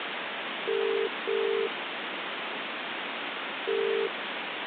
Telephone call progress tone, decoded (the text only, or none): ringback tone